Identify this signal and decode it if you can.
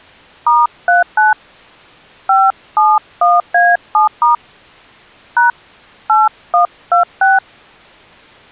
DTMF, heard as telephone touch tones, dialled by hand, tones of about 160 ms. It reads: *39 571A7* # 8126